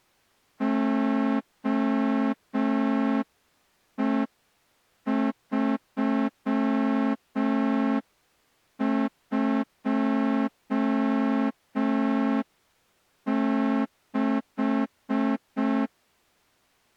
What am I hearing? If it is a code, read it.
Morse code, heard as a horn, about 5 wpm. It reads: OE326